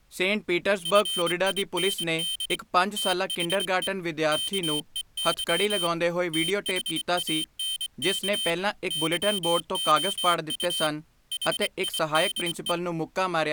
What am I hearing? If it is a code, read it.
Morse code, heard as a high beeper, hand-sent with a paddle, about 24 wpm, 3100 Hz, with speech in Punjabi. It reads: FIND THE KEY THANK YOU HIDE